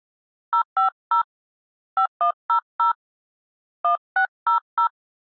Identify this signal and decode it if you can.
DTMF, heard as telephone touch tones, dialled by hand, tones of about 100 ms. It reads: 050 5100 1600